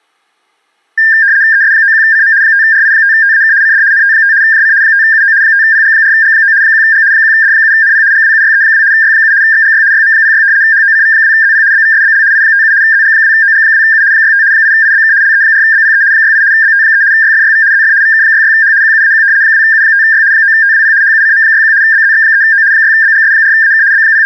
RTTY (75 baud, 170 Hz shift), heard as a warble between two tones, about 1700 Hz centre. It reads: ES91CM 5RI5TAK CD NT5 JC 5UO 5PG4G9 1G 1D7NP GWUYE2 Y7 XGY YM06 HOCV2ZP BVSBL I57 ZG2OG2U 65 8IBK LE4BPE 68 BT3 YFYV ZF VK66H QUAQ 2U5Y 9TWP HUCM61 BZX3O 6BGS4AK …